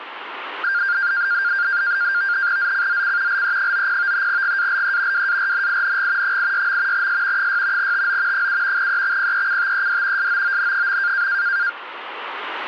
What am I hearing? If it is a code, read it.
NAVTEX (SITOR-B), 100 baud, 170 Hz shift, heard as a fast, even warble, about 1500 Hz centre. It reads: ZCZC LE90 GALE WARNING 86. S 6 TO 7 EXPECTED SOON.